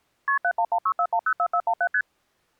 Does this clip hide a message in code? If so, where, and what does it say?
Yes: multi-frequency trunk signalling (R1, as on North American trunks) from 0.3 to 2.0 s, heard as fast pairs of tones, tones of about 70 ms. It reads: KP 71164104417 ST